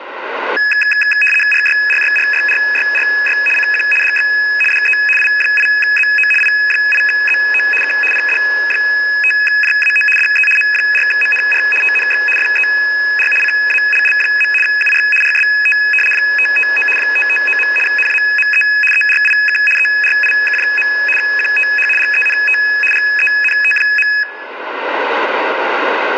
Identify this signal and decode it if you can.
RTTY (75 baud, 850 Hz shift), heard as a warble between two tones, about 2100 Hz centre, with radio static. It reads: RYRYRYRYRY CQ DX DE I8ZO I8ZO K PD5JAO DE M4MNR TNX FER CALL. UR RST 559 559. NAME ERIK ERIK. QTH GENT GENT.